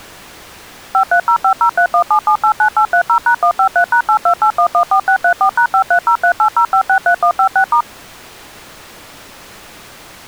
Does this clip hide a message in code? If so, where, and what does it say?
Yes: DTMF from 0.9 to 7.8 s, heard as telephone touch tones, dialled by machine, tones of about 90 ms. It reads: 53050317789830#153#828114634#530380563156*